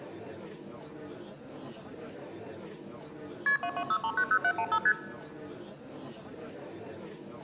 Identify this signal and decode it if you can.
Multi-frequency trunk signalling (R1, as on North American trunks), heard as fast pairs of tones, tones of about 70 ms, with room echo. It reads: KP 226390715 ST